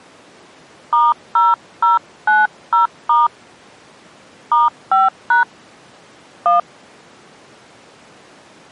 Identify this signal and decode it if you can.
DTMF, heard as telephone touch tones, dialled by hand, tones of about 160 ms. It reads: *0090* *5# 1